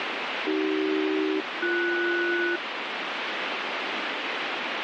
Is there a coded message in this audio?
Yes: aircraft SELCAL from 0.5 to 2.6 s, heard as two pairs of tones, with radio static. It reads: AC-BS